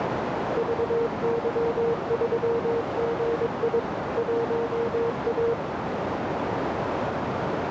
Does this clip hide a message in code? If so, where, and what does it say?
Yes: Morse code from 0.5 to 5.6 s, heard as a keyed tone, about 22 wpm, 460 Hz, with heavy radio static and a narrow filter. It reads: VY3GI 1A